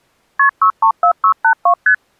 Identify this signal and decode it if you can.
Multi-frequency trunk signalling (R1, as on North American trunks), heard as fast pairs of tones, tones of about 90 ms. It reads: KP 634682 ST